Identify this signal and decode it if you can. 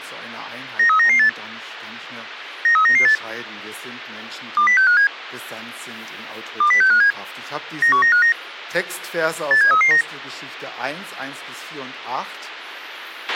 Five-tone selective call (CCIR), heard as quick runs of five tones, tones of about 100 ms, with a squelch burst at the end. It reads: 93998 93998 20657 20657 91959 87339